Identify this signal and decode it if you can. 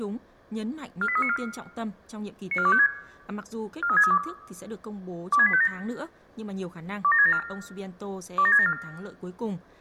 Five-tone selective call (ZVEI), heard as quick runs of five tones, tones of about 70 ms, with room echo and speech in Vietnamese. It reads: 48394 94256 43632 26857 27674 27674